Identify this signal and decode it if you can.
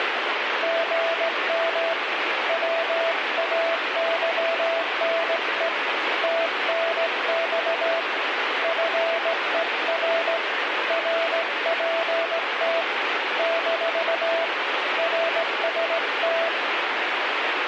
Morse code, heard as a keyed tone, hand-sent with a straight key, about 17 wpm, 660 Hz, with radio static. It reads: GM WAYNE TNX FER RPT - RST